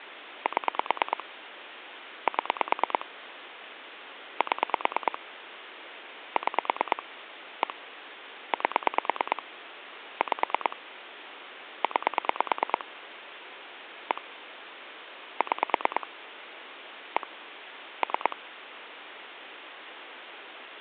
Pulse dialling, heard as clicks on a phone line, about 9 pulses a second, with phone line noise. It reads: 7 7 7 6 1 8 5 9 1 6 1 3